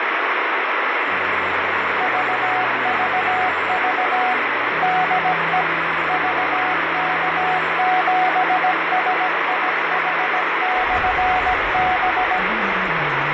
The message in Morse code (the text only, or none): VVV DE VK7SIH/B